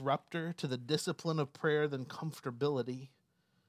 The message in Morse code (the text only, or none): none